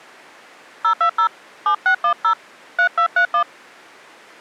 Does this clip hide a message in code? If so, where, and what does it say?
Yes: DTMF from 0.8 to 3.4 s, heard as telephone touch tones, dialled by hand, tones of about 90 ms. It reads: 020 7610 3231